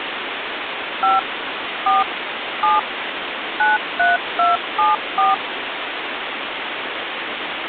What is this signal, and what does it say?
DTMF, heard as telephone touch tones, dialled by machine, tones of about 170 ms, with phone line noise. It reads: 5 4 7 93274